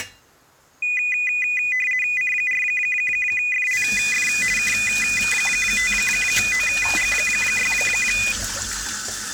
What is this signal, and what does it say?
RTTY (50 baud, 450 Hz shift), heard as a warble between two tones, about 2250 Hz centre, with kitchen noise. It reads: C4FLF K5OG6